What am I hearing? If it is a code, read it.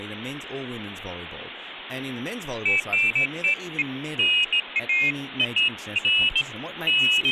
Pairs of high tones at irregular times, with phone line noise and speech in English. There is no code.